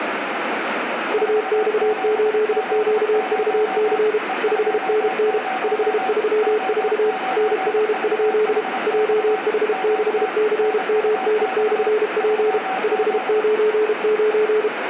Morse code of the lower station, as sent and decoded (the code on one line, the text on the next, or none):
..- -..- ---.. --.- ...- -.-. / ..... -. -. / ..... ...-- ....- / -. .-. ..--.. / .--- .... -.... -.-. -- -. -..-. .--. / ..... ----. ----.
UX8QVC 5NN 534 NR? JH6CMN/P 599